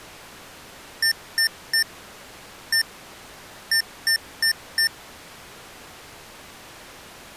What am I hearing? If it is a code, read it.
Beep code, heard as beeps from a small speaker, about 1800 Hz. 3-1-4. In Phoenix BIOS tables: interrupt mask register failure.